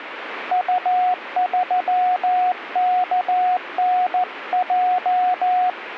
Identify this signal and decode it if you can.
Morse code, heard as a keyed tone, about 14 wpm, 730 Hz, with radio static. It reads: U3KNJ